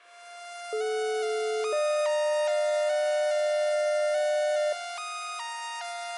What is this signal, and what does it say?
Two-tone page, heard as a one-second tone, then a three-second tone, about 430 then 600 Hz.